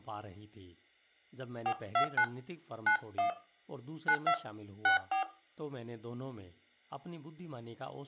DTMF, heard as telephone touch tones, dialled by hand, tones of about 100 ms, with room echo and speech in Urdu. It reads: 429 91 92 64